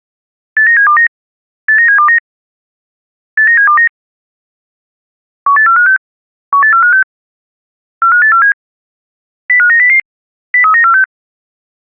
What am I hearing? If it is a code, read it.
Five-tone selective call (CCIR), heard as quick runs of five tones, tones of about 100 ms. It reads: 89729 89729 89729 18456 18456 45847 05900 03946